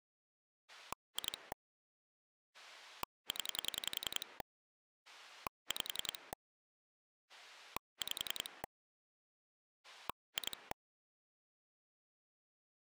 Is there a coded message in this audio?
Yes: pulse dialling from 0.7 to 10.7 s, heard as a rotary dial, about 10 pulses a second. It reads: 2 0 5 5 2